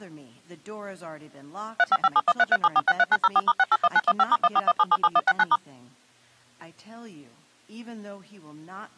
DTMF, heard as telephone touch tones, dialled by machine, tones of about 40 ms. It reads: 35571337463904*681915*141777169*